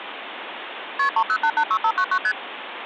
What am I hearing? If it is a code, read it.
Multi-frequency trunk signalling (R1, as on North American trunks), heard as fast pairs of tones, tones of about 70 ms, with phone line noise. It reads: KP 30886599 ST